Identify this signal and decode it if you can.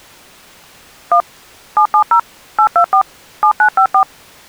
DTMF, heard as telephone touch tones, dialled by machine, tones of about 90 ms. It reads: 1 770 824 7954